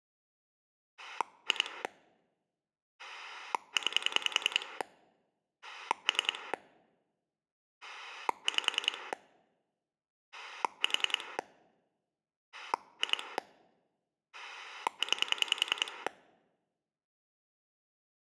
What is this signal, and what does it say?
Pulse dialling, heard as a rotary dial, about 10 pulses a second. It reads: 2 9 3 5 4 2 9